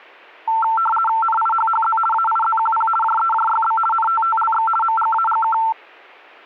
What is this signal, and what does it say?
RTTY (50 baud, 450 Hz shift), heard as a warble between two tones, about 1120 Hz centre. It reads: NIHHZ AIZQP JEJYB NTTLX MGAGK